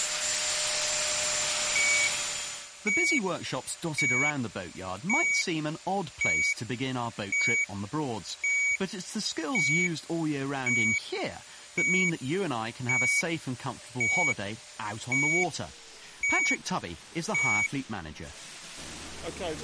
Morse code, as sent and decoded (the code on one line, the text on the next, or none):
none